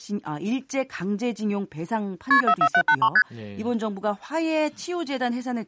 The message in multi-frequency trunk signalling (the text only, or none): KP 44783 ST